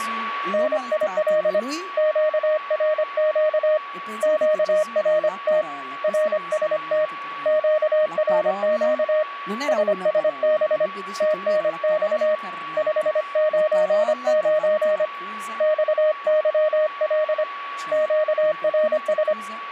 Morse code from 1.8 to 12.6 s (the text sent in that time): QRQ QRT RST QRQ SSB TNX